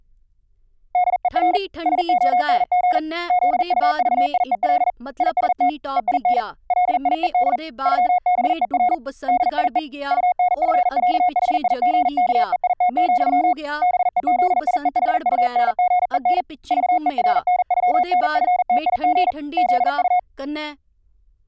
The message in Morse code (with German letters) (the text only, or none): DER SONG ZUVIEL IST EIN LIED ÜBER DIE UNFÄHIGKEIT, BEZIEHUNGEN VERNÜNFTIG ZU